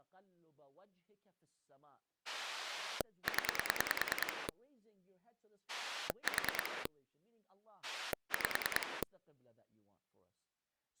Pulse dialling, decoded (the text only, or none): 0 4 5